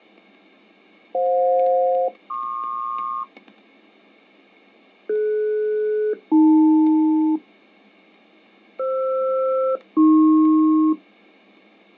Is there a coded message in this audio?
Yes: aircraft SELCAL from 1.1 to 10.9 s, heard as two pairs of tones, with fading and static crashes. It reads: FJ-PQ DS-AL FR-AP